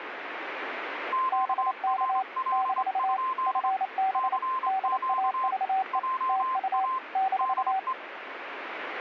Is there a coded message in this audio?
Yes: Morse code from 1.1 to 8.0 s, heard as two keyed tones, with radio static. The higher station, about 25 wpm, 1040 Hz: QRL? CQ JA DE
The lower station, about 28 wpm, 770 Hz: BK - FB DAVE TU -